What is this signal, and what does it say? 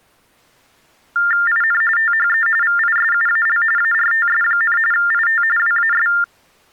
TTY/TDD text telephone tones (45.45 baud Baudot), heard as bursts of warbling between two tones, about 400 Hz shift, 1600 Hz centre. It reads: IN THE VISUAL ARTS, IT WAS